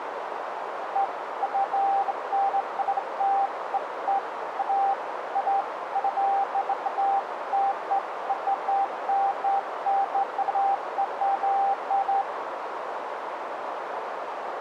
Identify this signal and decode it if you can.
Beeps of irregular length, with radio static and a narrow filter. There is no code.